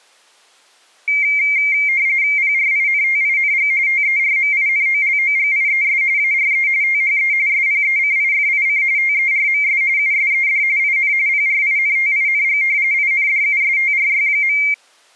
RTTY (45.45 baud, 170 Hz shift), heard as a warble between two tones, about 2200 Hz centre. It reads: PRINTING TERMINOLOGIES ARE THE SPECIFIC TERMS USED IN PRINTING INDUSTRY.